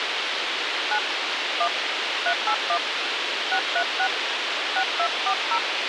DTMF, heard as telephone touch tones, dialled by hand, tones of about 70 ms, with radio hiss and a squelch burst at the end. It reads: 9 1 381 636 6240